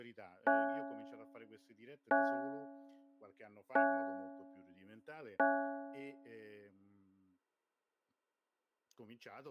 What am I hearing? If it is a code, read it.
Clock strike, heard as a bell, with speech in Italian. 4. Four o'clock.